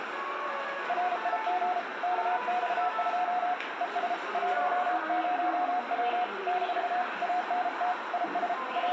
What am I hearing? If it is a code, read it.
Morse code, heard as a keyed tone, hand-sent with a paddle, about 33 wpm, 720 Hz, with radio static, a narrow filter, room echo and the noise of a subway station. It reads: RIG KX2 ES 10W - ANT IS …